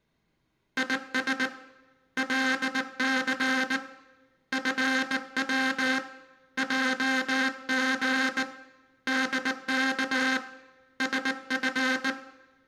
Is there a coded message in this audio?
Yes: Morse code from 0.7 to 12.2 s, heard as a buzzer, hand-sent with a bug key, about 19 wpm, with room echo. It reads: IS LC FW JG DK SF